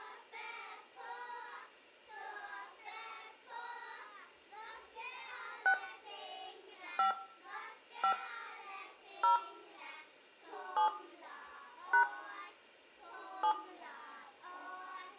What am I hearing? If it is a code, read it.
DTMF, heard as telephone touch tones, dialled by hand, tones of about 100 ms, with room echo. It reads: 6 5 5 0 7 # 7